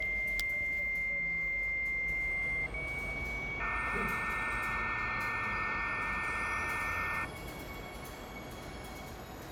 Dial-up modem handshake (low-speed, two carriers), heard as two whistles, then hiss, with room echo and the noise of a subway station.